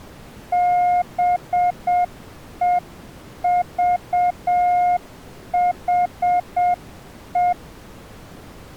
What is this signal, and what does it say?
Morse code, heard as a keyed tone, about 7 wpm, 710 Hz. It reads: BEVHE